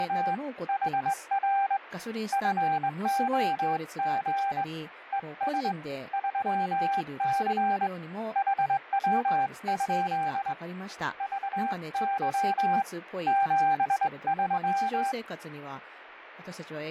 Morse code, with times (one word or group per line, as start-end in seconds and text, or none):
0.0-0.3 …
0.7-1.8 HR
2.3-4.6 FOG
5.1-5.7 ES
6.1-7.9 3C
8.4-10.5 HW?
11.2-12.8 VY
13.3-15.1 73